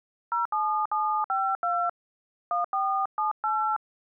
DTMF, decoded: 07752 1478

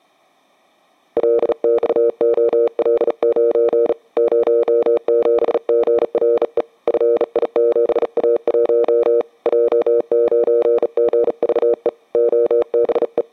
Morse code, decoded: LXOL9 07GRE FI7A1 J9GVE …

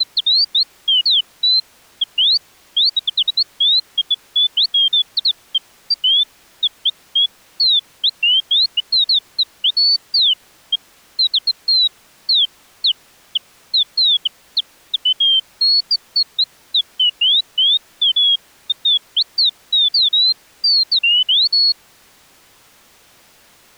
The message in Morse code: none

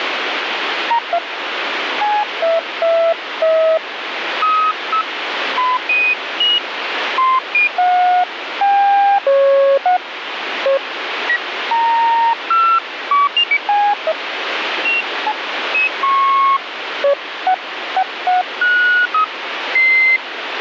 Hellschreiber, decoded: none

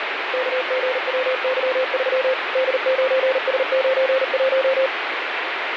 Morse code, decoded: KGWY3 D9S91

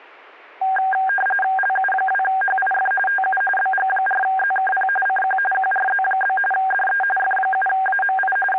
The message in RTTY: LU2HIF TU BG4ZKP CQ QRZ? DE F7AMI …

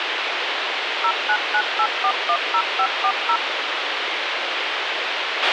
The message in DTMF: 0998410540

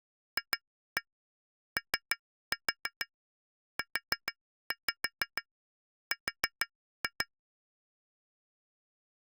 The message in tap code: FOUR

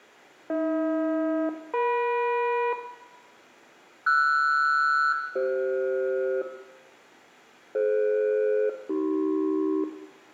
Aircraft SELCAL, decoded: AH-EM RS-CF DF-AC

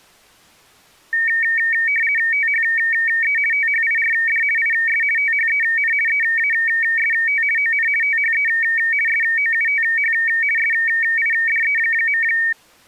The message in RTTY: THE THIRD IS THEN EAST ON THE SOUTH SIDE.

